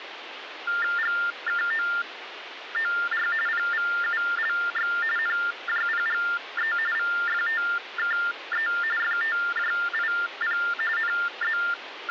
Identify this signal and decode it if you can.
TTY/TDD text telephone tones (45.45 baud Baudot), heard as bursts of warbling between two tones, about 400 Hz shift, 1600 Hz centre, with phone line noise. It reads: GKOOR PVULX NJPGE VFTKE FTJIP …